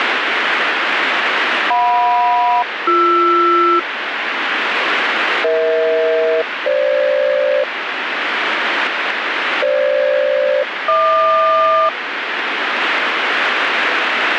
Aircraft SELCAL, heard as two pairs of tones, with radio static. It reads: JM-BR EH-FG FG-HQ